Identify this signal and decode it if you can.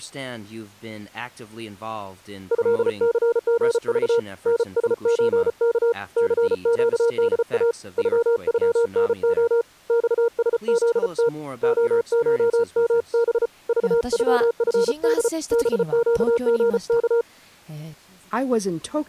Morse code (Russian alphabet), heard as a keyed tone, hand-sent with a paddle, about 34 wpm, 470 Hz. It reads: ЭЦГЖ НСЧК ЦЩДА ЮЮНО ЬСЗТ ОШМБ ЖЮФД БЩГК